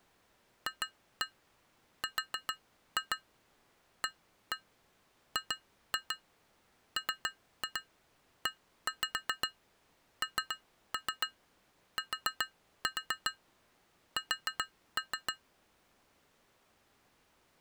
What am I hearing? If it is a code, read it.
Tap code, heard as taps on glass, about 7 knocks a second. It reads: FRAGMENTS